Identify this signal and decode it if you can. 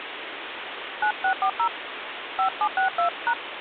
DTMF, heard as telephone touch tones, dialled by hand, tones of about 90 ms, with phone line noise. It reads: 9640 5762#